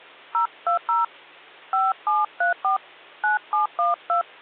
DTMF, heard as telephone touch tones, dialled by hand, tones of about 150 ms, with hum. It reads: 020 5734 9712